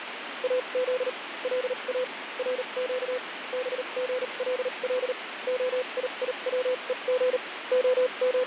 Morse code (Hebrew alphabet), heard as a keyed tone, machine-sent, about 38 wpm, spaced as for 31 wpm, 510 Hz, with radio static. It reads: אז לא רק בגלל הייצוג …